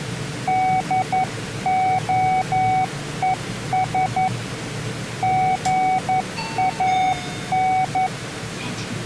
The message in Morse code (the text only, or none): DOES GAN